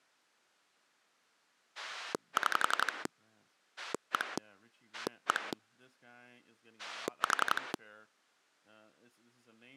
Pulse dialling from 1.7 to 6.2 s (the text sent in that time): 6 1 1